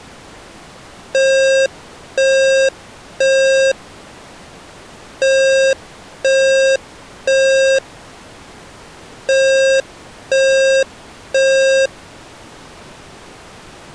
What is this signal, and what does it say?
Alarm pattern, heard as an alarm's beeps, played three times, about 540 Hz. Temporal three. Smoke or fire, evacuate.